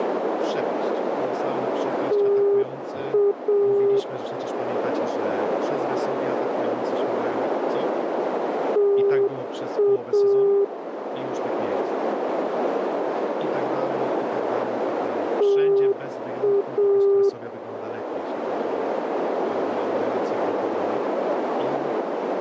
Morse code, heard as a keyed tone, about 7 wpm, 400 Hz, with radio static, a narrow filter and speech in Polish. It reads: TA TA TA